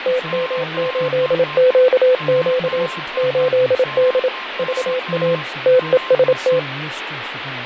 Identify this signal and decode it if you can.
Morse code, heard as a keyed tone, machine-sent, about 27 wpm, 510 Hz, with radio static, fading, a weaker station near 1050 Hz and speech in English. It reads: TM8QQ 8D VA TEST